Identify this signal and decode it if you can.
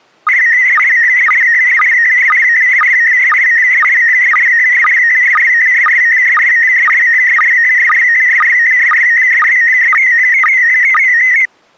SSTV (slow-scan television), PD 120, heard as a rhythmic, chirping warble.